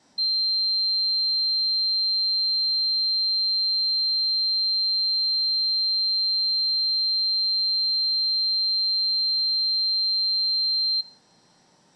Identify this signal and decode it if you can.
A steady tone, with room echo. There is no code.